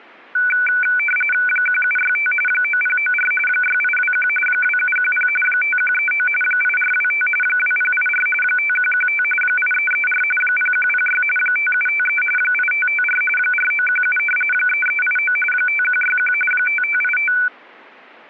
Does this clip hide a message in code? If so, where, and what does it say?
Yes: RTTY (45.45 baud, 850 Hz shift) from 0.3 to 17.5 s, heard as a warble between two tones, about 1900 Hz centre. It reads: 1765 9094 6821 2710 5139 8425 2084 5115 8334 0106 5753 8554 4917 3389 5161 5585